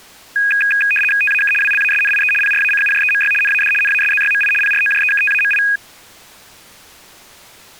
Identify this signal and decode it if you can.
RTTY (75 baud, 850 Hz shift), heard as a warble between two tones, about 2050 Hz centre. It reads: TAK WLASNIE PRACUJEMY NAD NASZYMI PROJEKTAMI